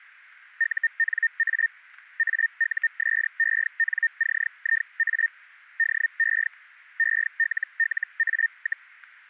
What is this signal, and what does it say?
Hellschreiber (Feld-Hell, 122.5 baud), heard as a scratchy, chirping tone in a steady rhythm, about 1800 Hz. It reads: UNA AUSENCIA DE ELLA,